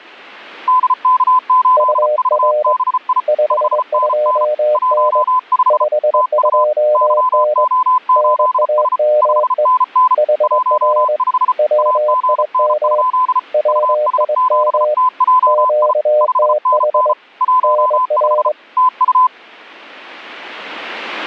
Morse code, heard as two keyed tones. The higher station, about 34 wpm, 1010 Hz: DK8VBI 5NN 15 TU YO8S 5NN 15 AGN? US7TJI 5NN 15 TU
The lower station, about 22 wpm, 600 Hz: UR 52N 52N NAME HR WIM WIM QTH NR